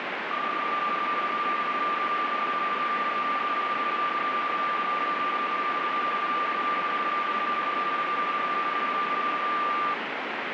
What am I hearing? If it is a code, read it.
PSK31 (31.25 baud), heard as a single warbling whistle, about 1190 Hz, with radio static.